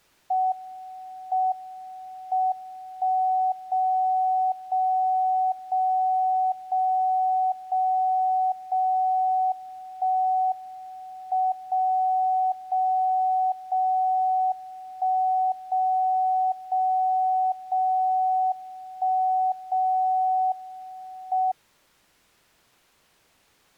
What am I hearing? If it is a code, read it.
Radio time signal (WWVB), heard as a tone whose level steps once a second, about 750 Hz. The time is 12:41 UTC. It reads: M M 1 0 0 0 0 0 0 1 M 0 0 0 1 0 0 0 1 0 M